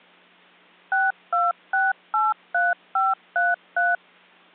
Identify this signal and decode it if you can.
DTMF, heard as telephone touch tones, dialled by machine, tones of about 190 ms. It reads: 62683533